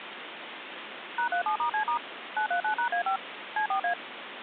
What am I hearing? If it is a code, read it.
DTMF, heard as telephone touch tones, dialled by machine, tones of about 100 ms, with phone line noise. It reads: #37*C* 939#A5 C4A